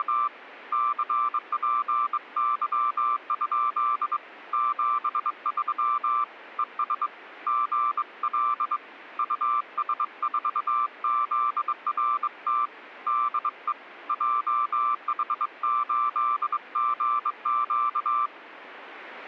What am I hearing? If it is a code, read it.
Morse code, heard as a keyed tone, hand-sent with a straight key, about 22 wpm, 1180 Hz. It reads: … CPY? 73 ES GL US4ZRT DE JH8GQ